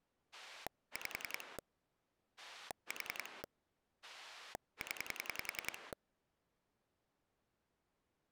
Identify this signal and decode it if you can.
Pulse dialling, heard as a rotary dial, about 10 pulses a second. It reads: 5 4 0